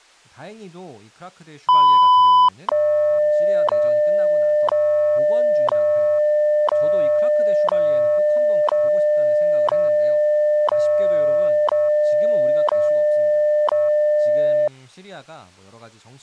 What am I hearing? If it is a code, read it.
Radio time signal (WWV, Colorado), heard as ticks, one a second, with speech in Korean.